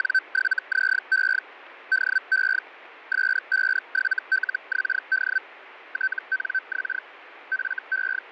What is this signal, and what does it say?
Hellschreiber (Feld-Hell, 122.5 baud), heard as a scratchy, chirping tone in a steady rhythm, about 1550 Hz, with radio static. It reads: … DE S57LXD TNX …